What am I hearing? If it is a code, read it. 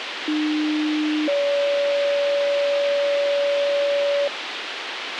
Two-tone page, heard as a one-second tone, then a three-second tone, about 300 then 570 Hz, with radio hiss and a squelch burst at the end.